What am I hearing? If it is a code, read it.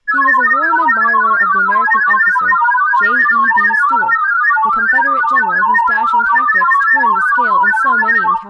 Multi-tone FSK (Olivia or MFSK type), about 1000 Hz wide, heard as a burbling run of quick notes, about 31.25 baud, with speech in English.